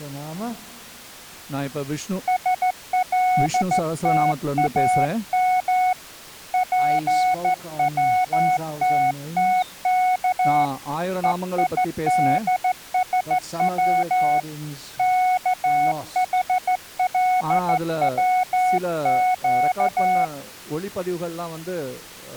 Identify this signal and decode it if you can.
Morse code (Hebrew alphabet), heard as a keyed tone, hand-sent with a straight key, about 14 wpm, 740 Hz. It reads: שלתאם פצתתך וידשץ כחלצק